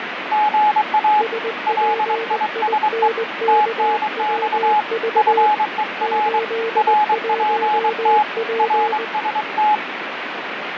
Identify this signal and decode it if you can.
Morse code, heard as two keyed tones, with radio static and fading. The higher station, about 23 wpm, 840 Hz: GA LISE TNX FER RPT RST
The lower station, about 20 wpm, 450 Hz: SPINKWV 81P